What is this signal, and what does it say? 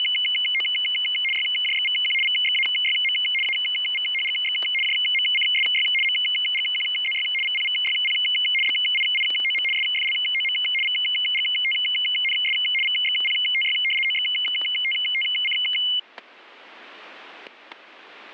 RTTY (75 baud, 850 Hz shift), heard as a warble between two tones, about 2550 Hz centre, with static crashes. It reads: … YJXVQ VXAYM AVHGX JMCSY MGQZY VPVYP BIIOM SFLOM VGTNS VXPTY OXTTC